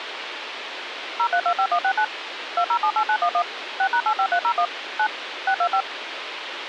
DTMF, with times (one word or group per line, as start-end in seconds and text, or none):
1.2-2.0 0325169
2.6-3.4 2078911
3.8-4.7 6#85301
5.0-5.1 9
5.5-5.8 625